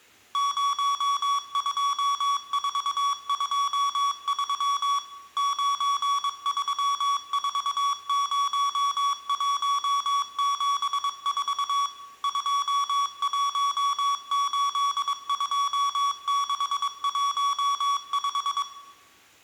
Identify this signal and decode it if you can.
Morse code, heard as electronic beeps, machine-sent, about 22 wpm, 1130 Hz, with room echo. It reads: 02423 9340174 2182615